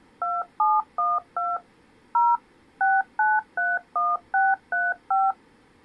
DTMF, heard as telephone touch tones, dialled by machine, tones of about 200 ms. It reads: 2712 0 6931635